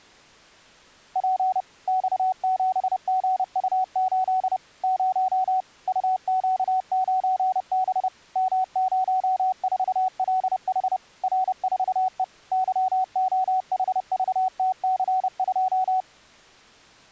Morse code, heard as a keyed tone, machine-sent, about 30 wpm, 750 Hz. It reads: P X7GU8 0 UQ9B M04LH R4E YOHVTC2